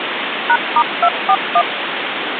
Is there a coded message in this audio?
Yes: DTMF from 0.5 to 1.6 s, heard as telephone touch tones, dialled by machine, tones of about 60 ms, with phone line noise. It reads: #*241